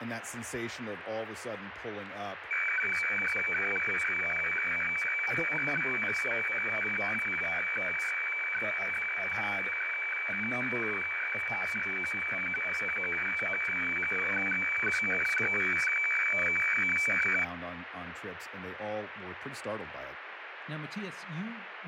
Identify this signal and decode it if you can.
Weather fax (radiofax), 120 lines a minute, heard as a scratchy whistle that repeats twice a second, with radio static and speech in English.